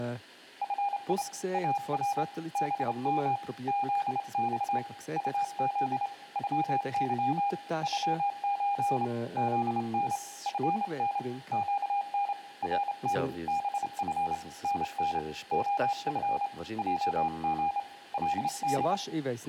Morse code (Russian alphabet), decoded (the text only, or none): ФИ АР БМ ЗЬ УЗ ЮЫ ЮЧ ЗН ФН ЩН РТ БФ НН ОФ ЙГ ЛД